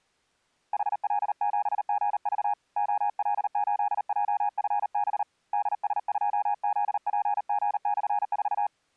Morse code, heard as a keyed tone, hand-sent with a paddle, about 38 wpm, 820 Hz. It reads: HL7GV OL8JFB DS2ZPG/4